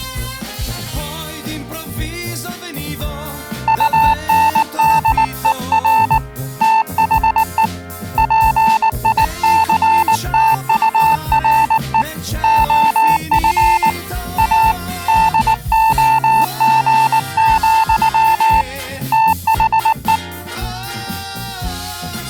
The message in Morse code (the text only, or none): UNDER THE PICTURE OF A DOG, THE